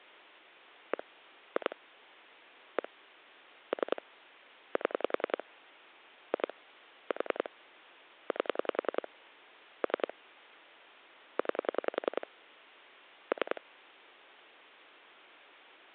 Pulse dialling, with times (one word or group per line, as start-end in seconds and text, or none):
0.9-1.0 1
1.6-1.8 2
2.8-2.9 1
3.7-4.0 3
4.8-5.4 7
6.3-6.5 2
7.1-7.5 4
8.3-9.1 8
9.8-10.1 3
11.4-12.3 9
13.3-13.6 3